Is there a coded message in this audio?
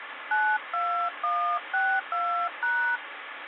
Yes: DTMF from 0.3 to 3.0 s, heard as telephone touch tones, dialled by hand, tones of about 300 ms, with phone line noise. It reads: 92162#